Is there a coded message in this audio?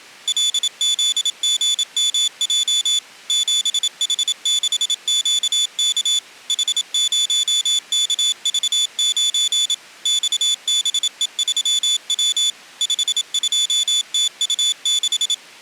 Yes: Morse code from 0.2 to 15.4 s, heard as a high beeper, machine-sent, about 27 wpm, 3500 Hz. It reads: LZGMJ 7H6QK H0KV9 XBE3W 52TU6